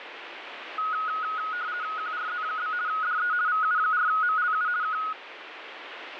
RTTY (50 baud, 170 Hz shift), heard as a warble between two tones, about 1360 Hz centre, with radio static. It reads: QRZ? DE VU4MLU K